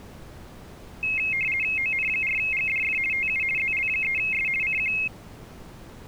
RTTY (50 baud, 450 Hz shift), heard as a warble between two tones, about 2350 Hz centre. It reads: ON4GDF TU ZL3S CQ